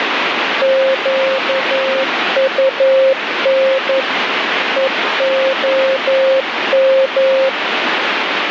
Morse code (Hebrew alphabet), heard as a keyed tone, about 11 wpm, 530 Hz, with radio static. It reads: קטן והם